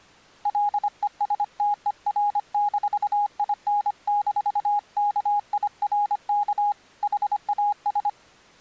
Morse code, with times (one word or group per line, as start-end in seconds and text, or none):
0.5-6.7 LESTER-IN-KIRK
7.0-8.1 HAS